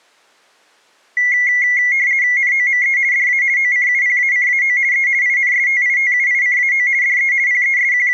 RTTY (50 baud, 170 Hz shift), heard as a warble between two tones, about 2050 Hz centre. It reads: NOME DA OCUPACAO E INSTITUICAO DE …